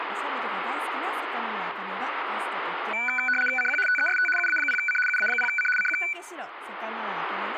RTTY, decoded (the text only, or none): CQ TEST UA0C UA0C CQ